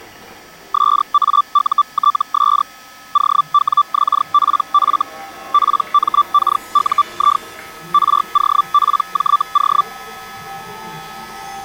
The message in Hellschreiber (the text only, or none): SAUTS OWXPF PMKUI ROPJO